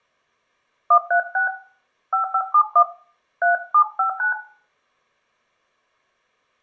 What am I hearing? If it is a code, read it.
DTMF, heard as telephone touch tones, dialled by hand, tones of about 100 ms, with room echo. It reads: 136 5571 3759